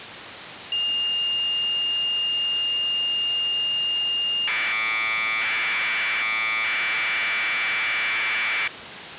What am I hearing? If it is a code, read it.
Commodore tape loading (standard loader), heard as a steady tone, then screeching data, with tape hiss.